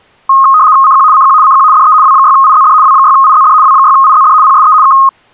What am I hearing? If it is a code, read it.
RTTY (75 baud, 170 Hz shift), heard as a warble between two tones, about 1160 Hz centre. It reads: CQ CQ CQ DE W6IZD W6IZD W6IZD PSE K